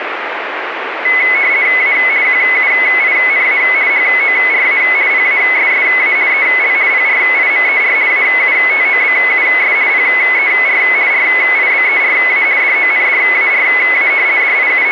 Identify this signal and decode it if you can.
RTTY (50 baud, 170 Hz shift), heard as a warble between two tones, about 2100 Hz centre, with radio static. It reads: A QUINA HORA PASSA EL PRIMER AUTOBUS PER RIBERA DONDARA …